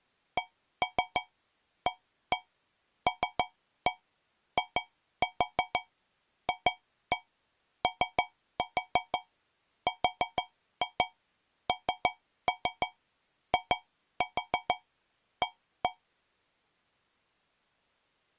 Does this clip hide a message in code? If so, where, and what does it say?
Yes: tap code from 0.4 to 16.0 s, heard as taps on a metal pipe, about 6 knocks a second. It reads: CALIFORNIA